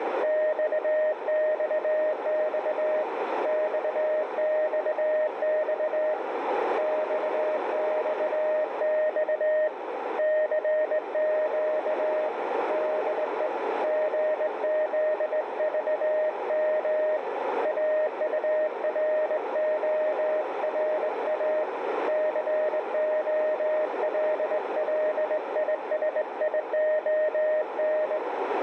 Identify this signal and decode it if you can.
Morse code, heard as a keyed tone, hand-sent with a straight key, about 19 wpm, 620 Hz, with heavy radio static and a narrow filter. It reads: XXX XXX XXX CQ DE GZVM AURORA COLLISION